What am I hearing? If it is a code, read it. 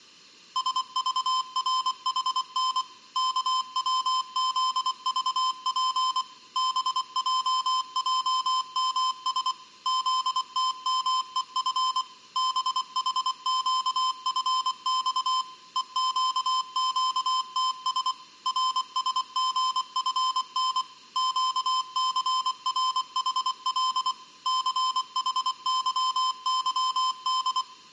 Morse code, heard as electronic beeps, machine-sent, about 24 wpm, 1030 Hz, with room echo. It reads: SVRHN KWZVP BJJMS ZTMEF BHQFX EQQTS RSGFN QCRHL CHYYD